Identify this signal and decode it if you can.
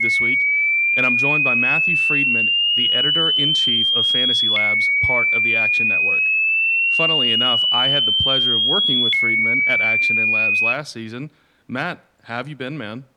A tone that sweeps in pitch again and again, with speech in English. There is no code.